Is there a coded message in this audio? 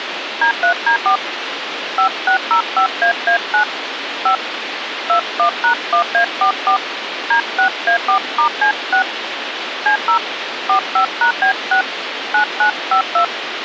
Yes: DTMF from 0.4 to 13.2 s, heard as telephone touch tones, dialled by hand, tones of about 100 ms, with radio hiss. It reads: D3D4 5605AA9 5 21#1A44 D6A4*C6 C0 45#B6 9952